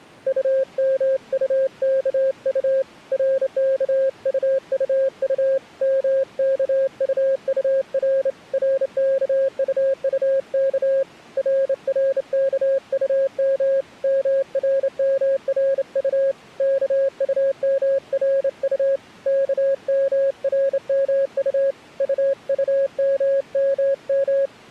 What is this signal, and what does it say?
Morse code, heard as a keyed tone, hand-sent with a straight key, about 28 wpm, 540 Hz. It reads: UMUKU RKUUU MKUUR RKUUK RRKUM MRMRU KUMRU KMRMU UUMMM